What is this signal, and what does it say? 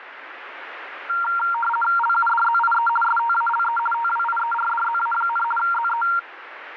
RTTY (50 baud, 450 Hz shift), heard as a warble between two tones, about 1160 Hz centre, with radio static. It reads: LUDZIE STALE TWIERDZA, ZE